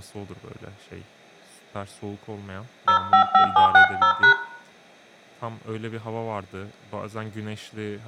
DTMF, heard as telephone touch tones, dialled by hand, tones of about 100 ms, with room echo and speech in Turkish. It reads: 055760#